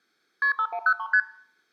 Multi-frequency trunk signalling (R1, as on North American trunks), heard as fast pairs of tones, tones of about 70 ms. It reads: KP 5103 ST